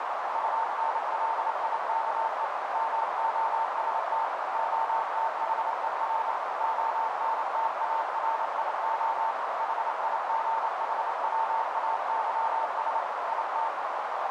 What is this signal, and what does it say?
Morse code, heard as a keyed tone, machine-sent, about 28 wpm, 900 Hz, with heavy radio static and a narrow filter. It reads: UNLIKE MOST OTHER ONTARIO HIGHWAYS IT